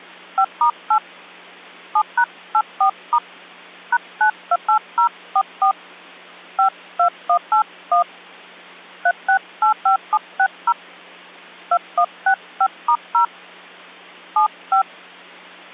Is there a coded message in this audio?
Yes: DTMF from 0.4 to 14.8 s, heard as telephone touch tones, dialled by hand, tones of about 80 ms. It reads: 5*8 7#84* #928044 52181 3685760 2165*0 75